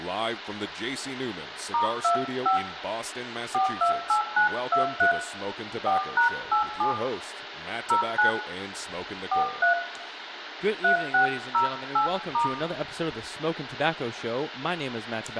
DTMF, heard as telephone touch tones, dialled by hand, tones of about 120 ms, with phone line noise, room echo and speech in English. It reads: *25 428923 4#87 09 43 3608*